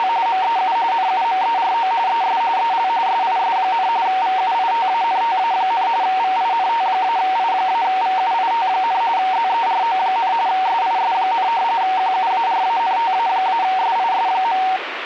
RTTY (45.45 baud, 170 Hz shift), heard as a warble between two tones, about 840 Hz centre, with radio static. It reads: … MEU NUMERO ES EL SIS, VUITANTA, VINT-I-VUIT, ZERO, SIS, QUARANTA-SIS.